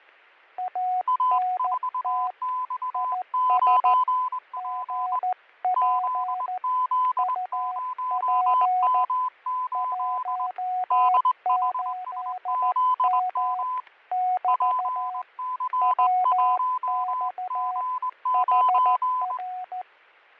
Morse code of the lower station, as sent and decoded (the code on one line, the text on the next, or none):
.- -. - / .. ... / --. .--. / ..- .--. / .---- ---.. -- / -...- / .-- -..- / .... .-.
ANT IS GP UP 18M <BT> WX HR